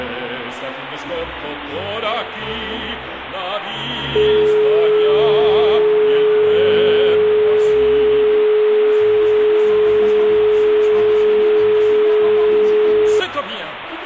Telephone call progress tone (425 Hz plan, as in most of Europe), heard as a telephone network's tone, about 420 Hz. Dial tone.